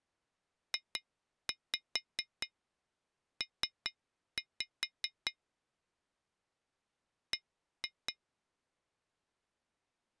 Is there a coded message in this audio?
Yes: tap code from 0.7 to 8.2 s, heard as taps on glass, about 4 knocks a second. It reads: JP B